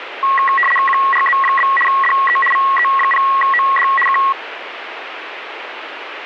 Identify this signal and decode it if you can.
RTTY (75 baud, 850 Hz shift), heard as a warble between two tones, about 1500 Hz centre, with radio static. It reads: QRZ? DE VE0OD K